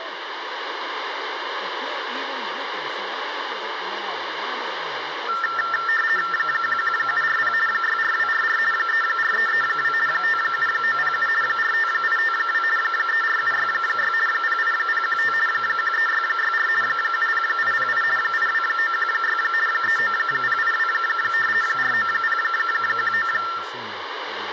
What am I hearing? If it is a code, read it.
RTTY (50 baud, 450 Hz shift), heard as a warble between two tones, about 1600 Hz centre, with radio static and speech in English. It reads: 11740 64244 34332 57907 45852 34766 08015 13664 70808 82916 39082 49019